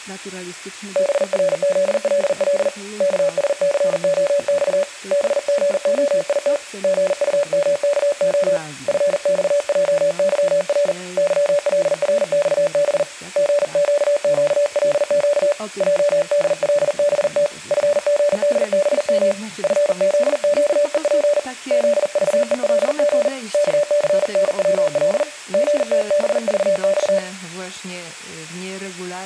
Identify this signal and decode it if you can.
Morse code, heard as a keyed tone, hand-sent with a paddle, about 40 wpm, 580 Hz. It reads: BRZLL KSCOX BGOIT GUMKO FXJYR YLRXB GQQLQ JDLBT FGDBM FZQEP ZVELG KCNWL GTBVX